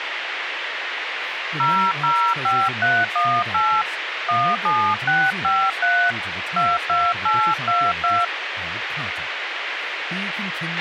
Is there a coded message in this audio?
Yes: DTMF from 1.6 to 8.2 s, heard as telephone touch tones, dialled by hand, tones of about 260 ms, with radio hiss and a squelch burst at the end. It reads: 005318 17653 22822